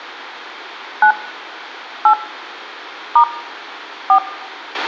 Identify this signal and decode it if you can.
DTMF, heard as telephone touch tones, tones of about 80 ms, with a squelch burst at the end. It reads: 9 8 * 4